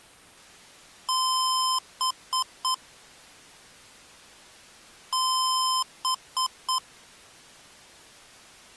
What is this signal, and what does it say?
Beep code, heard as beeps from a small speaker, played twice, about 1030 Hz. 1 long, 3 short. In Award and IBM BIOS tables: video adapter failure; in AMI BIOS tables: memory failure.